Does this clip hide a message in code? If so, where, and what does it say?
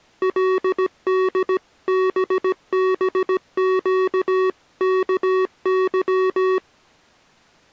Yes: Morse code (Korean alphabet) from 0.2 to 6.6 s, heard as electronic beeps, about 17 wpm, 370 Hz. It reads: 그때에